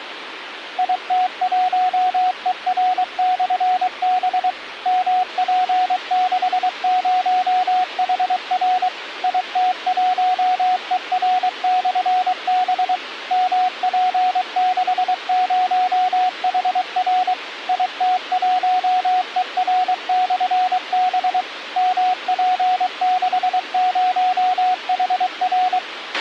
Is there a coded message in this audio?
Yes: Morse code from 0.7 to 25.8 s, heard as a keyed tone, machine-sent, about 23 wpm, 740 Hz, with radio hiss and a squelch burst at the end. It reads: IT1ER/B MP60HR IT1ER/B MP60HR IT1ER/B MP60HR